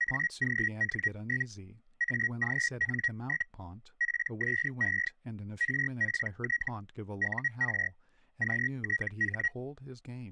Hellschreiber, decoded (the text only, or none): AGN? AGN? PSE RPT UR QTH